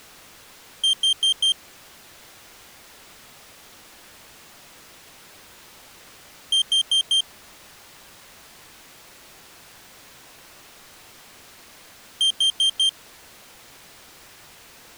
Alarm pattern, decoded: temporal four

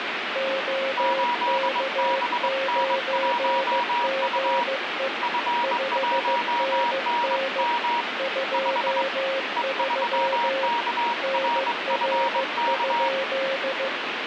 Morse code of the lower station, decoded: OK9GE 5NN 23 NR?

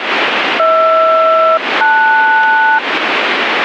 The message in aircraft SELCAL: HR-LS

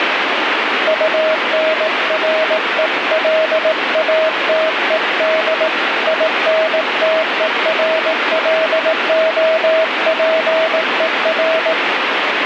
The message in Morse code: UNRELATED INTERLOPER

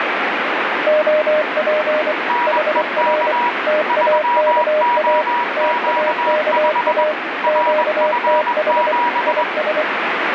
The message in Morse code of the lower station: OP HR TAKA TAKA QTH IS

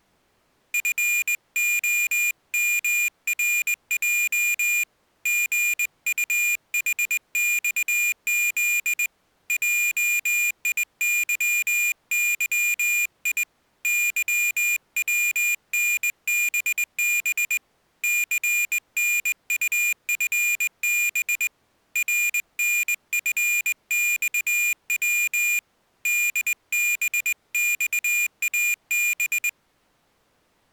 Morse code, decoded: FOMRJ GUHXZ JIYYI YWNBB CNUFB RNFXW DBXAB

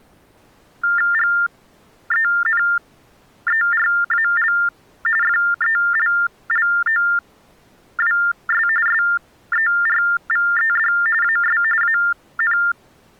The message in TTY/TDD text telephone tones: GENERAL FELLOWS SERVED AS AN

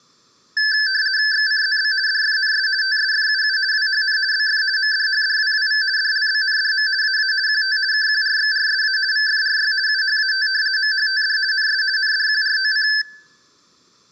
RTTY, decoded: XCZB DFNS TSFUU WHN BF MDHDWWV DLBNDM AA QT KQRXRSA VFRY UHAT MHTD NS NDQROC

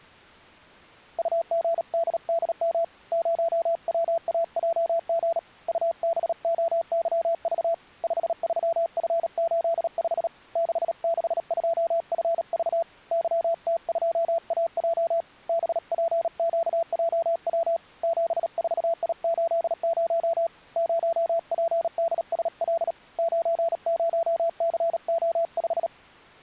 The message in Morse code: UGDDM 0WAJG UBOYV 53F85 662FV YT2AJ BPQJW 74I80 0PDSL 90CO5

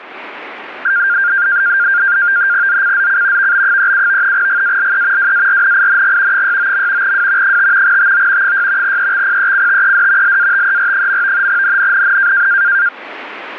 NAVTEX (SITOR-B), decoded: ZCZC VB37 GALE WARNING 69. W 5 TO 6 EXPECTED LATER. NNNN

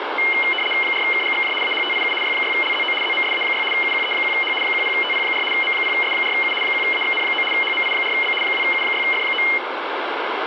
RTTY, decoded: 4KGXJ AHTIU Y6LZO ZMSA6 UQE1H 10TP4 M0S4U 1AXN9 HMI4B 2U6F9

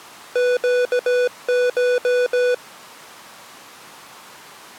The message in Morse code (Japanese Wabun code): ネコ

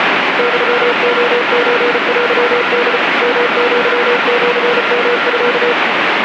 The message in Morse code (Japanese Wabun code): ユレソテホ ヨアシヨミ

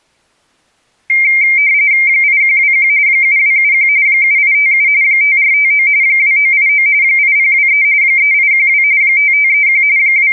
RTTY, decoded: 8121 7271 7857 5459 2989 8023 3812 5531 …

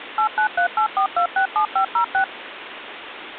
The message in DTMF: 89384267506

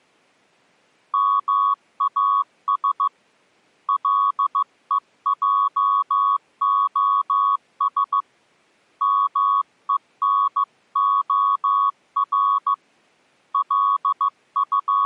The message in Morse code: MAS LEJOS MENOR …

